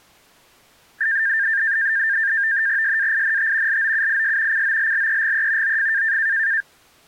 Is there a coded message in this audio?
Yes: NAVTEX (SITOR-B), 100 baud, 170 Hz shift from 1.0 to 6.6 s, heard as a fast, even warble, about 1700 Hz centre. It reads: SAINT LOUIS COLLEGE OF